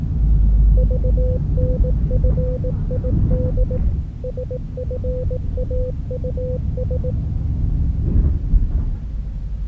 Morse code, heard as a keyed tone, machine-sent, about 18 wpm, 500 Hz, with the noise inside a bus. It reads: VNFID SFAUS